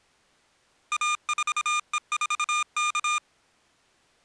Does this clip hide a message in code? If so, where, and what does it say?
Yes: Morse code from 0.9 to 3.2 s, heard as electronic beeps, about 26 wpm, 1210 Hz. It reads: A4E4K